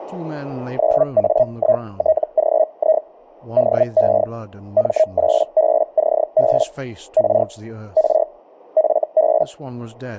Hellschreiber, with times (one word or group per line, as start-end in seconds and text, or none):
0.8-3.0 9A1TGI
3.6-4.2 DE
4.8-6.6 M8BCB
7.2-7.4 R
8.0-8.2 R
8.8-9.4 FB